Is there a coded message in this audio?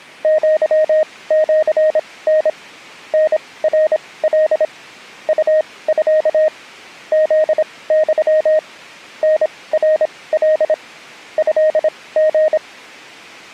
Yes: Morse code (Japanese Wabun code) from 0.2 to 12.6 s, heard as a keyed tone, machine-sent, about 26 wpm, spaced as for 19 wpm, 620 Hz. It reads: アシタ タナカ ウミ フユ タナカ トリ